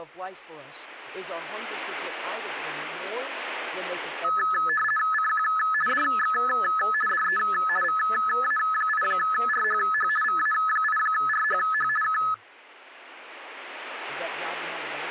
RTTY (50 baud, 450 Hz shift), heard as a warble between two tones, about 1500 Hz centre, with speech in English. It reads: CQ DX DE VA8RHH VA8RHH K